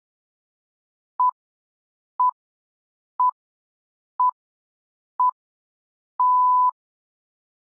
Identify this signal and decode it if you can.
Radio time signal (six pips, as the Greenwich Time Signal), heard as pips.